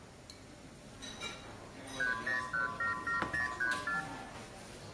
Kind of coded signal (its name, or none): multi-frequency trunk signalling